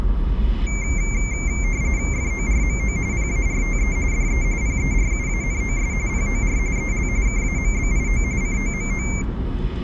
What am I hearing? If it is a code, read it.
RTTY (45.45 baud, 170 Hz shift), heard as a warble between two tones, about 2200 Hz centre, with the noise inside a car. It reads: FORMO PARTE DE PERUANOS POR EL KAMBIO COMO